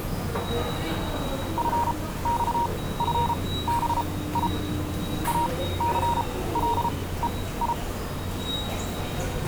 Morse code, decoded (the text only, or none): FXFBI ACLEI